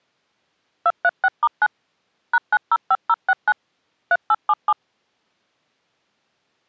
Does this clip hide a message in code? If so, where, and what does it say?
Yes: DTMF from 0.9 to 4.7 s, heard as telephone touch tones, dialled by machine, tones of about 50 ms. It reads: 236*9 #905069 3877